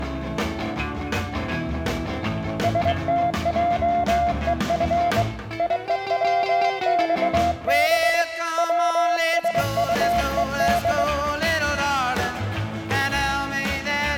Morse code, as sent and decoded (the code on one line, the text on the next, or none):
... - .--- . ..-. / .. . .-- -..- -... / .-- ... ..- . -..
STJEF IEWXB WSUED